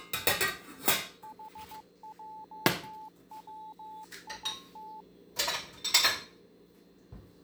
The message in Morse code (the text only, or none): HJWIT